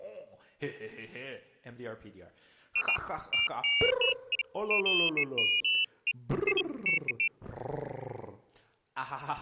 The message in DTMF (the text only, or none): none